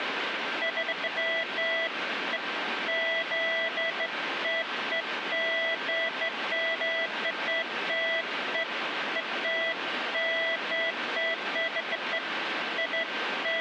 Beeps of irregular length, with radio static. There is no code.